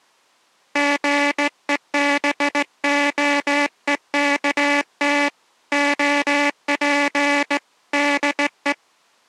Morse code, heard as a buzzer, hand-sent with a straight key, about 18 wpm. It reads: GEBOEKT OP DE